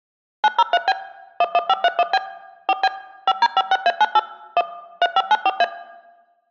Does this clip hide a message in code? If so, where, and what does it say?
Yes: DTMF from 0.4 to 5.6 s, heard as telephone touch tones, dialled by machine, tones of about 40 ms. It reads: 903B 11531B 4B 5D56A98 1 3594A